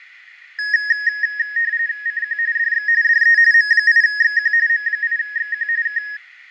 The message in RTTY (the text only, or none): CQ DX DE M8XQ M8XQ K